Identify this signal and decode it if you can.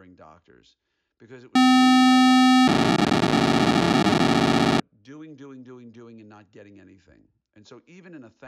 POCSAG pager data (512 baud), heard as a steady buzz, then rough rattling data, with speech in English.